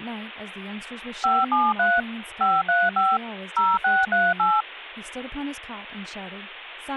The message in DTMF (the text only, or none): 573 535 0638